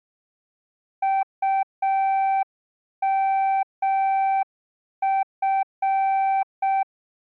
Morse code, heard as a keyed tone, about 6 wpm, 780 Hz. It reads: UMF